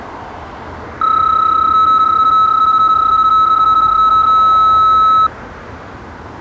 PSK31 (31.25 baud), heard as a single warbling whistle, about 1300 Hz, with street noise.